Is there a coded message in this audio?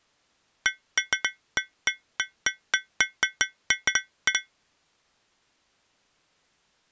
No, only irregular taps on glass.